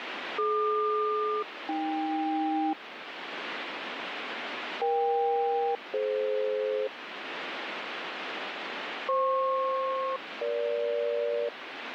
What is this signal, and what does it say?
Aircraft SELCAL, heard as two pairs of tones, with radio static. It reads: DQ-AK EK-DF FP-EG